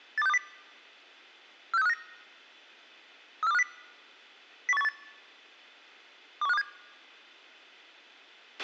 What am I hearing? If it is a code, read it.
Five-tone selective call (EEA), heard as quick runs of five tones, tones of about 40 ms, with a squelch burst at the end. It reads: 82620 46359 34250 01818 21527